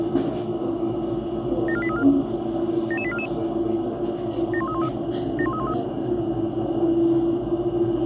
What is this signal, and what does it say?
Five-tone selective call (ZVEI), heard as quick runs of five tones, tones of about 70 ms, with the noise inside a bus. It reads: 74834 77844 71313 71313